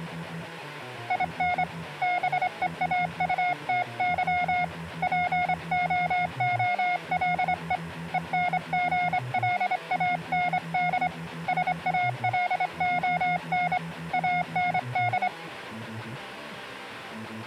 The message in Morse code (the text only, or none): IN BEAUTY POOLE ENGLAND SALON AND